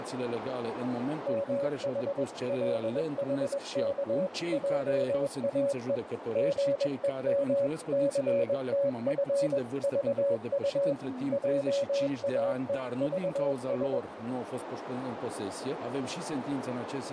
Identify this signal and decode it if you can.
Morse code (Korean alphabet), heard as a keyed tone, machine-sent, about 21 wpm, 560 Hz, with radio static and a narrow filter. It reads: 무궁화 삼천리 화려